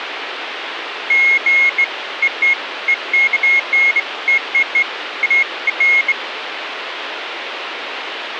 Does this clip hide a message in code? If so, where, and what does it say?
No, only beeps of irregular length, with phone line noise.